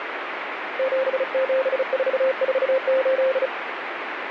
Morse code, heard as a keyed tone, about 35 wpm, 530 Hz, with radio static. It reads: 77448